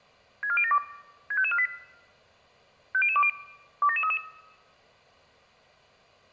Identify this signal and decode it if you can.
Five-tone selective call (ZVEI), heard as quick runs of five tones, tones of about 70 ms. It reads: 64072 65548 50020 27733